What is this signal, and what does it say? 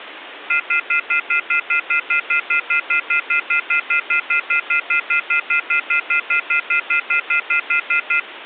Telephone call progress tone (North American plan), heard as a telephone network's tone, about 1400, 2050, 2450, 2600 Hz, 0.1 s on and 0.1 s off, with phone line noise. Off-hook warning tone.